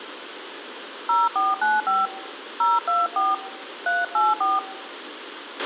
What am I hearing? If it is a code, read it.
DTMF, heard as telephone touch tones, dialled by hand, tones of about 190 ms, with radio hiss and a squelch burst at the end. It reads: 0495 024 384